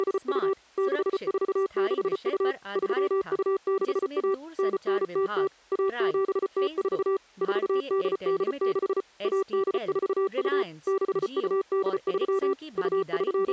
Morse code (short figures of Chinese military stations), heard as a keyed tone, machine-sent, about 34 wpm, 390 Hz, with speech in Hindi. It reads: … 6462 3261 9900 1704 4886 1842 6283 …